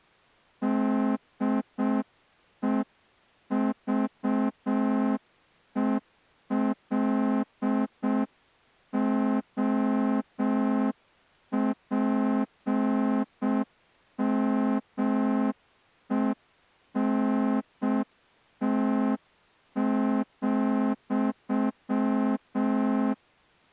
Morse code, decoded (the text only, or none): DEVELOPMENT,